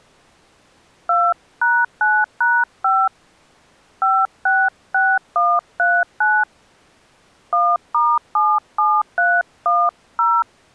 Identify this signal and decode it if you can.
DTMF, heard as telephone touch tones, dialled by hand, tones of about 230 ms. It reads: 2#9#5 566139 1*77310